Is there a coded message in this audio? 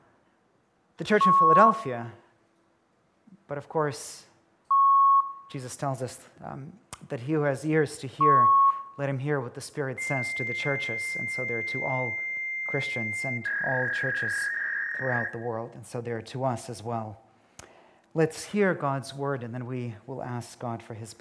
Yes: fax machine handshake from 1.2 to 15.3 s, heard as beeps, a long tone and a warble, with room echo.